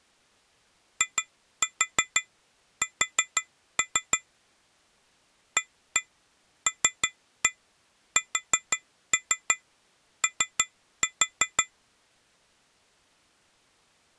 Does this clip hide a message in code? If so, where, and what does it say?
Yes: tap code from 1.0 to 11.7 s, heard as taps on glass, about 6 knocks a second. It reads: IS ALSO